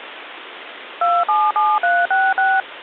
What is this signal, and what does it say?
DTMF, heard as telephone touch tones, dialled by machine, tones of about 220 ms, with phone line noise. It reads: 277366